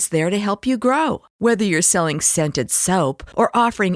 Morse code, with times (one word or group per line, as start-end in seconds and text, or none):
none